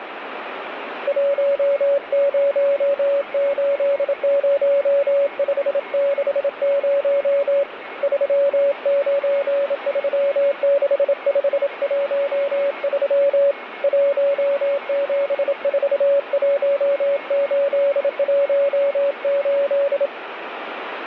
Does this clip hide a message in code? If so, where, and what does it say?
Yes: Morse code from 1.0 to 20.1 s, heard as a keyed tone, hand-sent with a bug key, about 27 wpm, 560 Hz, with radio static and a weaker station near 2180 Hz. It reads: 1080560 3936513 1741818